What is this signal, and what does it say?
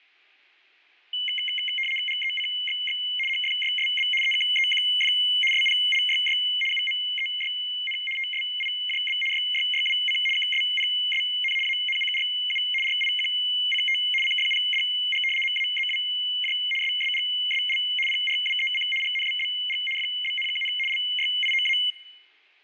RTTY (75 baud, 850 Hz shift), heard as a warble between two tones, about 2550 Hz centre, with fading. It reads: GECXX HFYSB EKEQF SPLYY UMEYN TSIJB YYYWC KSPSN ANCRU RIQCT CFPDG MAZWJ SSGSL PRWEC GNBBG FBNKN LYIOA